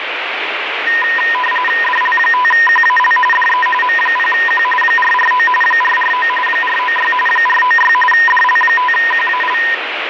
RTTY (45.45 baud, 850 Hz shift), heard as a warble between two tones, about 1420 Hz centre, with radio static. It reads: DL5QAL DE M0Q 449 449 496 496 DL5QAL